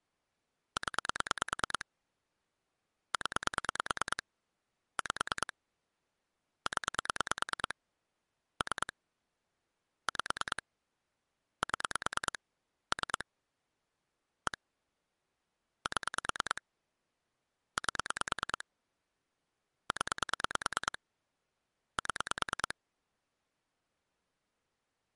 Pulse dialling, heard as clicks on a phone line, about 9 pulses a second. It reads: 0 0 5 0 3 5 7 3 1 7 8 0 7